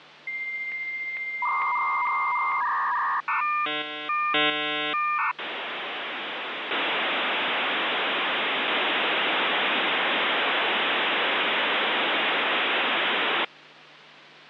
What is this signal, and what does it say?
Dial-up modem handshake (V.34 or later), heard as a whistle, warbles, then hiss, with phone line noise.